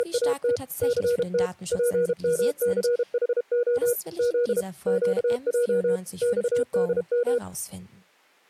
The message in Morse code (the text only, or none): … CT PMCHO Z QJ XDM